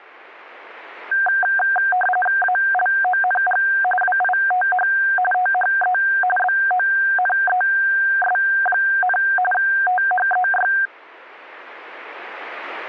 RTTY (45.45 baud, 850 Hz shift), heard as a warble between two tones, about 1160 Hz centre. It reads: ALONG WITH THE BONES, THEY